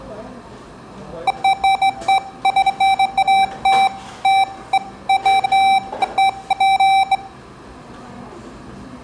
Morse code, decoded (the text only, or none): none